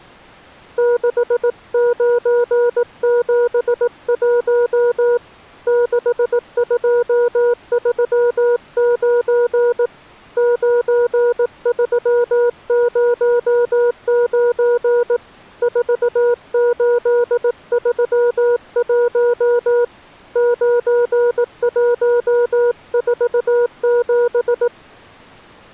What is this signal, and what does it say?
Morse code, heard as a keyed tone, hand-sent with a paddle, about 18 wpm, 480 Hz. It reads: 6971 6239 9309 4831 9147